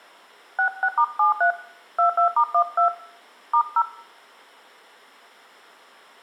DTMF, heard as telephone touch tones, dialled by hand, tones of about 100 ms, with room echo. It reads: 66*73 22*12 *0